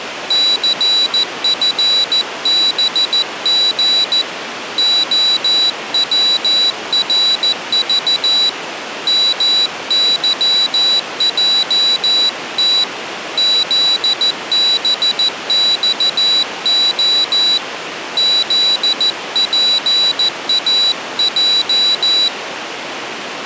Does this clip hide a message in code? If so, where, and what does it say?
Yes: Morse code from 0.2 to 22.3 s, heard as a high beeper, hand-sent with a paddle, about 14 wpm, 3950 Hz. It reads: CFBG OWRV MYJT ZBXO ZPAJ